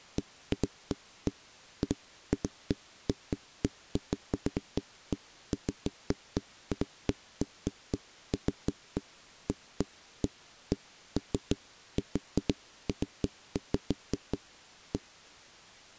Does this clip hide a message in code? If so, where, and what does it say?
No, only irregular knocks on a wall.